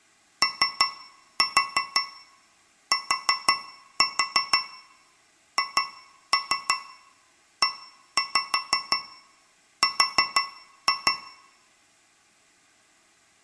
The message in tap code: OTHER

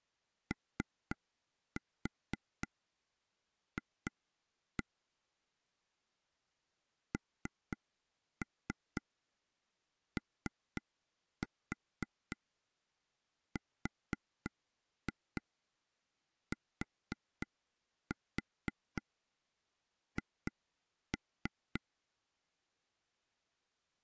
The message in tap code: OF NORTH

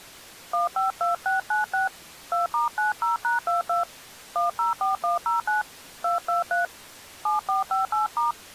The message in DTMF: 152696 2*90#22 104109 223 7458*

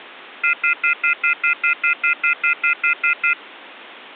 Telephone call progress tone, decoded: off-hook warning tone

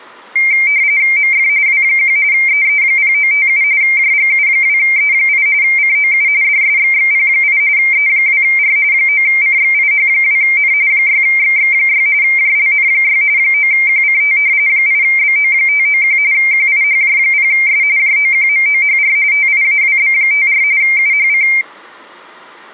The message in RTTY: MF W1 EE0957 JGU2E8 COU DSXXP8 E2R 9CXIH2N 6XX6 JLN6 9QCT 8BO591 QIHJ0S JOQMOHR TIAWB54 UHC

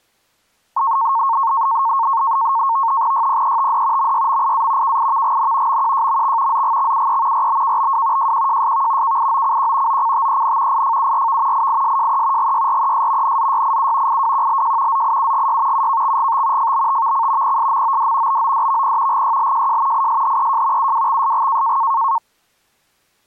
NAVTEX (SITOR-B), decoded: YPETD MYMIA KIVGN MQJMX ZGXUE RBKBW JQJSV KIOCQ OCTEN IFURV IISJE GYRES NZYIU IWQLJ ZIUGY UKXGT FBTVC PSMOD BODVP GYLJJ ISHEJ UWXSG

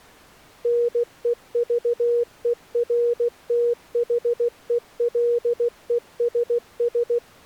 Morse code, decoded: NEVERTHELESS

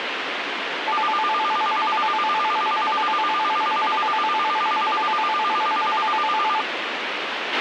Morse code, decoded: none

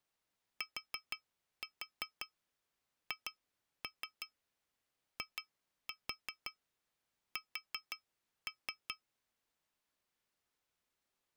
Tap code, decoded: THIS

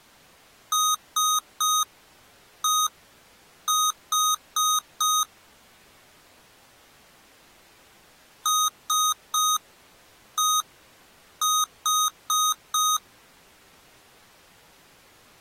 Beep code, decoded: 3-1-4

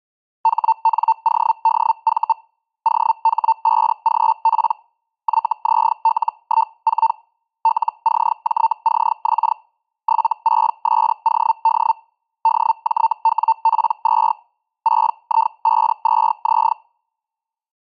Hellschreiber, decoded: HNODV OH5GP YZL14 LCJCX 76SOD DJWP2 6I52Z

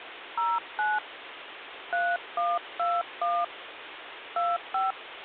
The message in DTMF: 09 3121 25

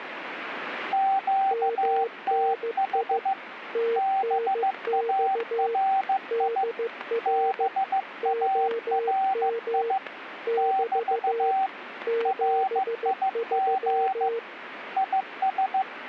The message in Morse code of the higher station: QTH BARI BARI <BT> RIG IS

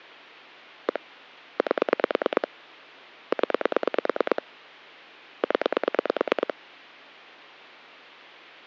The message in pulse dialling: 1 8 0 0

